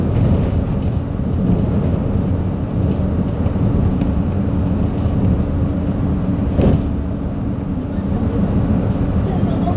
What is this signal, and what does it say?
The noise inside a bus. There is no code.